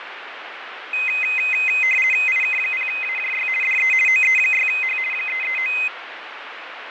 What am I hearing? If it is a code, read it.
RTTY (50 baud, 450 Hz shift), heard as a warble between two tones, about 2300 Hz centre, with radio static and fading. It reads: IK0AJY DE OE6H 339